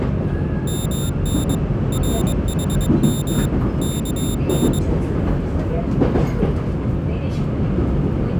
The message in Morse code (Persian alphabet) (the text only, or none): من رحم کن